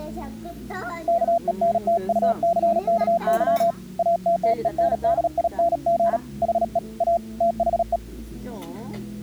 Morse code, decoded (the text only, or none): KENTUCKY ATTENDING HE A THE